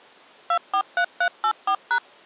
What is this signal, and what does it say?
DTMF, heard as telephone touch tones, dialled by machine, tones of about 80 ms. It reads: 243384#